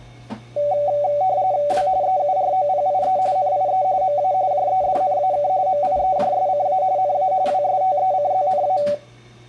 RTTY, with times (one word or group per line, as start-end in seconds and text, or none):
1.7-1.9 W
2.0-3.2 EUROPIE
3.4-3.8 NIE
4.0-4.3 MA
4.5-5.5 JEDNAK
5.7-6.8 MIEJSCA
7.0-7.3 NA
7.5-8.8 WSTECZNA